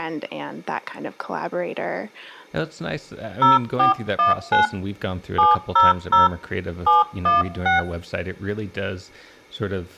DTMF, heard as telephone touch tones, dialled by hand, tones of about 150 ms, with room echo and speech in English. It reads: 0419 700 716